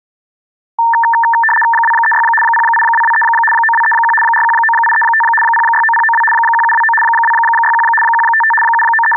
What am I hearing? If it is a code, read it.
RTTY (75 baud, 850 Hz shift), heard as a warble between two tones, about 1350 Hz centre. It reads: 236 08223 9231 419835 069092 1729 261 155 …